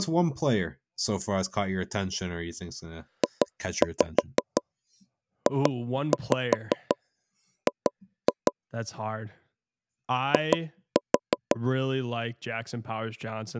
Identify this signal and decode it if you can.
Tap code, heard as knocks on wood, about 5 knocks a second, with speech in English. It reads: JJG I